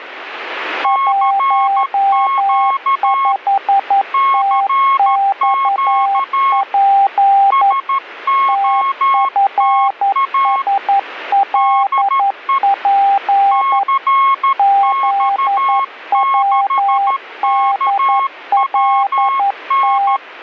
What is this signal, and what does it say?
Morse code, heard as two keyed tones. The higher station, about 13 wpm, 1090 Hz: CQ CQ SOTA DE CX6KWN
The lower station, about 11 wpm, 790 Hz: 15TXP TFSLP ZWDLT